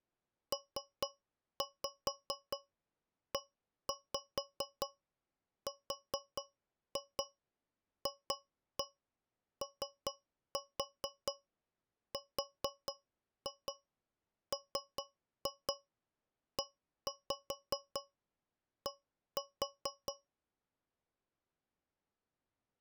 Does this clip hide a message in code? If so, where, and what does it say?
Yes: tap code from 0.5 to 20.3 s, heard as taps on a metal pipe, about 4 knocks a second. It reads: PERFORMED